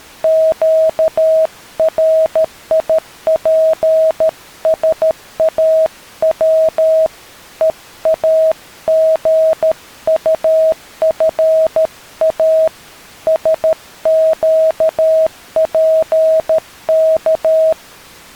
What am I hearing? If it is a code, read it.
Morse code, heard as a keyed tone, hand-sent with a paddle, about 13 wpm, 640 Hz. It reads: QRIPSAW EAGUFA SQPK